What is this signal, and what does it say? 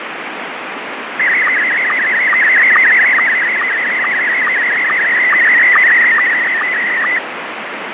SSTV (slow-scan television), Scottie S1, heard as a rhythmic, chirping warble, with radio static.